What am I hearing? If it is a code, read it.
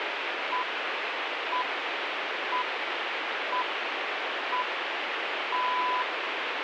Radio time signal (six pips, as the Greenwich Time Signal), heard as pips, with radio static.